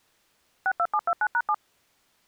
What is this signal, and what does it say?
DTMF, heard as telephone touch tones, dialled by machine, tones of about 60 ms. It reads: 62729#7